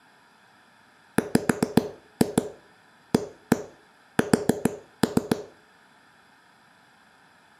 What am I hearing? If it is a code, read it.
Tap code, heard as knocks on a wall, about 7 knocks a second, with room echo. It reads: WAS